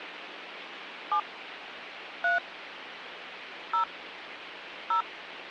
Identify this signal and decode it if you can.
DTMF, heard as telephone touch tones, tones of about 110 ms, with phone line noise. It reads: 7 3 0 0